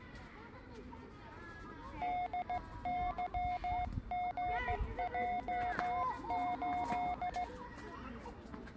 Morse code, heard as a keyed tone, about 16 wpm, 720 Hz, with the noise of a park. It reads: DYGJ8